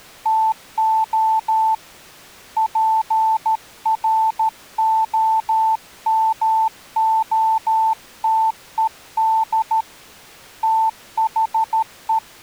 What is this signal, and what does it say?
Morse code, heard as a keyed tone, hand-sent with a paddle, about 13 wpm, 890 Hz. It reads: TO PROMOTED THE